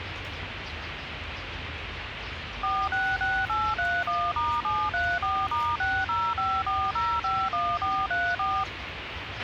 DTMF, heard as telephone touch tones, dialled by machine, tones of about 250 ms, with radio hiss, a squelch burst at the end and the noise of a park. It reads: 466831*734*6054051434